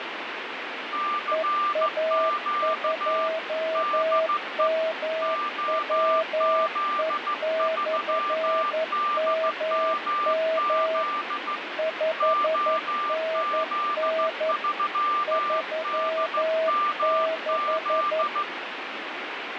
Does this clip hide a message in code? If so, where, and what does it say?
Yes: Morse code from 0.9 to 18.5 s, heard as two keyed tones, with radio static. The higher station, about 15 wpm, 1190 Hz: CQ DE OZ3DMZ OZ3DMZ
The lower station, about 11 wpm, 640 Hz: EA2MWE/MM 5NN 36